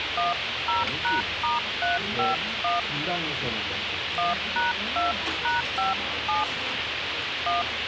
DTMF, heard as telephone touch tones, dialled by hand, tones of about 160 ms, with radio hiss, a squelch burst at the end and the noise of a restaurant. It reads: 10#*351 1#2#57 1